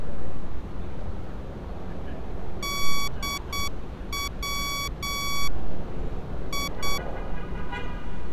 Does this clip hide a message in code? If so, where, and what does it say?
Yes: Morse code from 2.6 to 7.0 s, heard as electronic beeps, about 8 wpm, 1130 Hz, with street noise. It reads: DW I